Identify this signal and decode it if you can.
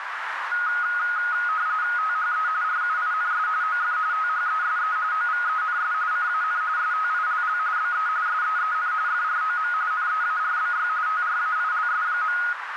RTTY (45.45 baud, 170 Hz shift), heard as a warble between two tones, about 1350 Hz centre, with radio static and a narrow filter. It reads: THE RUINS OF THESE OVENS CAN STILL BE SEEN FROM NEARBY TRAILS.